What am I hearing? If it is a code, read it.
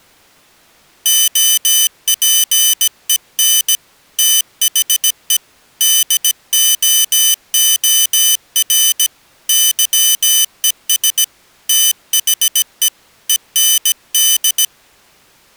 Morse code, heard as a high beeper, hand-sent with a paddle, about 17 wpm, 3000 Hz. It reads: OPEN THE DOOR YES THE END